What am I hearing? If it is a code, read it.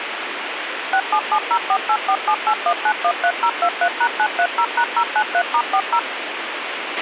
DTMF, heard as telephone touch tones, dialled by machine, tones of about 70 ms, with radio hiss and a squelch burst at the end. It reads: 6770484781913023#930#093*40